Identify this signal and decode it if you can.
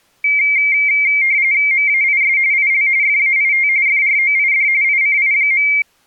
RTTY (45.45 baud, 170 Hz shift), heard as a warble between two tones, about 2200 Hz centre. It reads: MAIS IL FAIT FROID ICI.